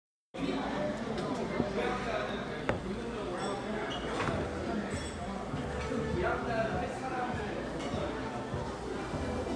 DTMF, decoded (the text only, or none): none